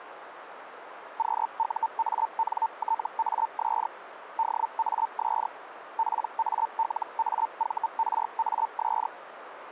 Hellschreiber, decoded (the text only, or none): QUANTAS DAS PALAVRAS